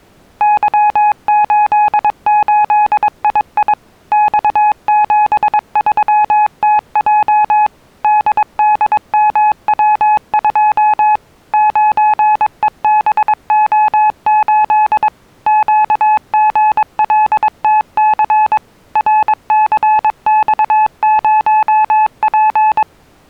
Morse code, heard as a keyed tone, machine-sent, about 22 wpm, 850 Hz. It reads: Y88II X73TJ DDMW2 9EBO8 QGLTC RCX0P